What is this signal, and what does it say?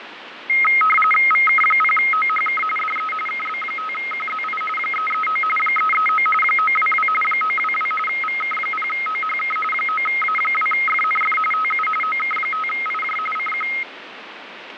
RTTY (45.45 baud, 850 Hz shift), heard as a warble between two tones, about 1700 Hz centre, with radio static and fading. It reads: VK0OHK DE KB5QZI 339 339 922 922 VK0OHK 9A2FNF TU OK5IJ CQ